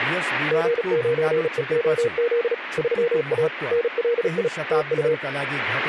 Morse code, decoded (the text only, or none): G9EOZ 3A NLI TU